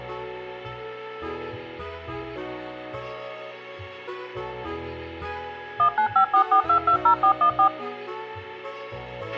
DTMF, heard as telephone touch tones, dialled by machine, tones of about 90 ms, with a squelch burst at the end. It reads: 19544220414